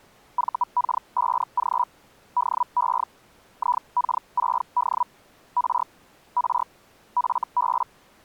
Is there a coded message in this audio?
Yes: Hellschreiber (Feld-Hell, 122.5 baud) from 0.4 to 7.8 s, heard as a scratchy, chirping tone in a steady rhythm, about 980 Hz. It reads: VK5G DE IK6D R R FB